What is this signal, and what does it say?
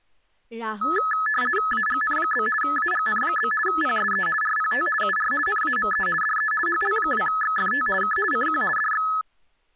RTTY (50 baud, 450 Hz shift), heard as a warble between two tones, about 1500 Hz centre, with speech in Assamese. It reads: AGN? AGN? PSE RPT UR NAME DE HL2XFT K CQ DX